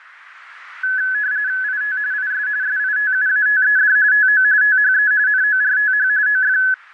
RTTY (45.45 baud, 170 Hz shift), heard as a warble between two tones, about 1600 Hz centre, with radio static. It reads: IT IS SITUATED TO THE NORTH OF